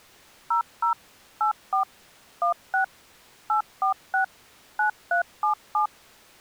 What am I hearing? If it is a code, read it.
DTMF, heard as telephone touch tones, dialled by machine, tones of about 110 ms. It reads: 00 84 16 846 9377